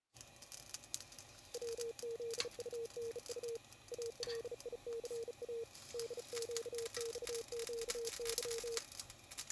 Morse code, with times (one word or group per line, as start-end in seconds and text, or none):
1.5-3.6 WZUNU
3.9-5.6 ALICA
5.9-8.8 DQXQY